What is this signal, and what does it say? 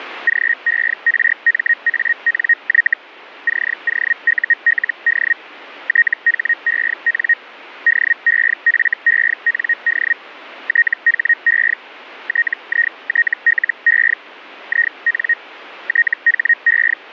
Hellschreiber (Feld-Hell, 122.5 baud), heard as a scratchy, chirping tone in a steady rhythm, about 1850 Hz. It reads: GERMANY COULD THEN DEFEND THE TITLE IN THE